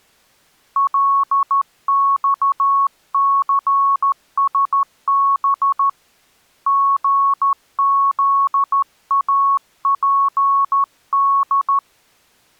Morse code, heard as a keyed tone, hand-sent with a straight key, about 13 wpm, 1110 Hz. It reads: LXCSB GZAPD